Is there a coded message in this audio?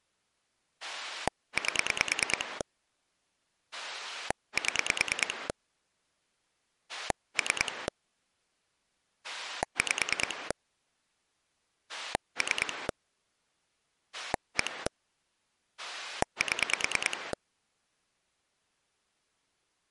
Yes: pulse dialling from 0.8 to 17.3 s, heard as a rotary dial, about 9 pulses a second. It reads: 8 7 3 5 3 1 7